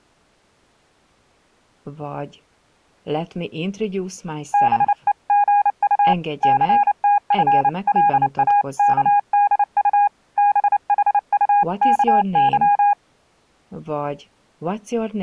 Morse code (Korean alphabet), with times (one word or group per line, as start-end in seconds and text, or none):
4.5-6.1 다시
6.4-10.1 천고의
10.4-12.9 뒤에